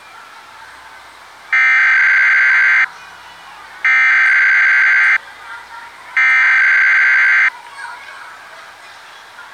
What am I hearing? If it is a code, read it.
Emergency Alert System (SAME) tones (header bursts), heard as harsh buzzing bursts, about 520.83 baud, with the noise of a residential street.